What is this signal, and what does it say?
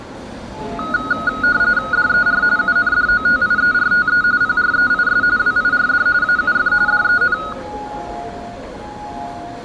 RTTY (45.45 baud, 170 Hz shift), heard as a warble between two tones, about 1360 Hz centre, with room echo and the noise of a subway station. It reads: DER UNDOTIERTE PREIS WIRD AUF DEN